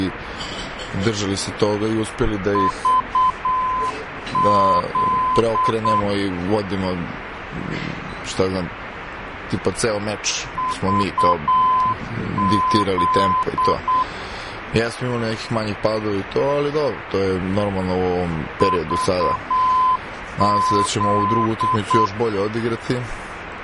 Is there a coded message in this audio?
Yes: Morse code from 2.5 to 22.1 s, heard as a keyed tone, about 8 wpm, 1020 Hz, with radio static. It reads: VZ VZ VZ